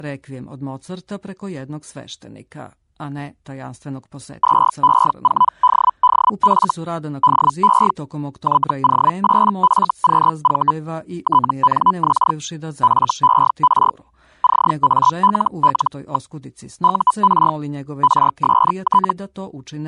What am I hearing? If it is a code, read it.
Hellschreiber (Feld-Hell, 122.5 baud), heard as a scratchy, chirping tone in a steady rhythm, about 1000 Hz. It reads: 2E4DDF DE YO8FQV TNX FER CALL. UR RST